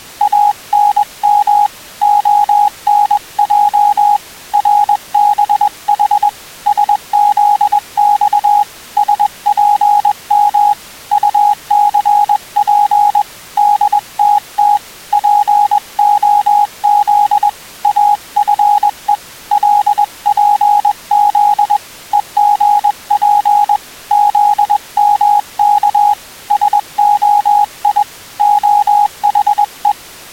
Morse code, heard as a keyed tone, hand-sent with a paddle, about 21 wpm, 830 Hz. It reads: ANM ONJ RBH SZX SPM UCP DTT POZ AFE LPZ EGP ZMK SOI OHE